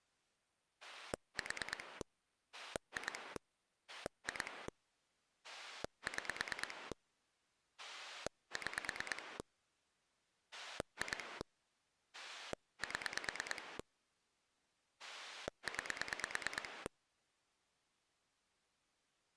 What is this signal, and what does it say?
Pulse dialling, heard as a rotary dial, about 9 pulses a second. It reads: 4 2 2 6 6 2 7 9